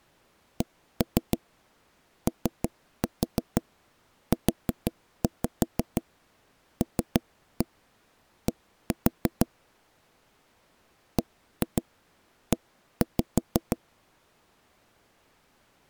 Tap code, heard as knocks on wood, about 6 knocks a second. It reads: COULD BE